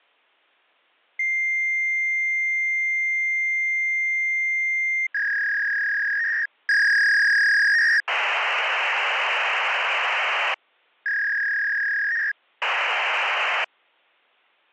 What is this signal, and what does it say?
Fax machine handshake, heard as a long tone, a warble and hiss.